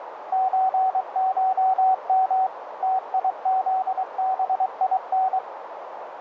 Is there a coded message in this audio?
Yes: Morse code (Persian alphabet) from 0.3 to 5.4 s, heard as a keyed tone, machine-sent, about 23 wpm, 760 Hz, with radio static and a narrow filter. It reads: چشم تیزبین